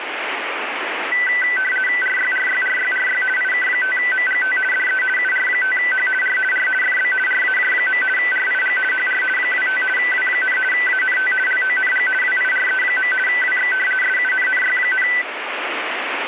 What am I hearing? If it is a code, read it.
RTTY (50 baud, 450 Hz shift), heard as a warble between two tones, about 1750 Hz centre, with radio static. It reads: RYRYRYRY IK5MGT DE UR5H R R FB RAJ. RIG HR 25 W, ANT LONG WIRE. WX SUNNY,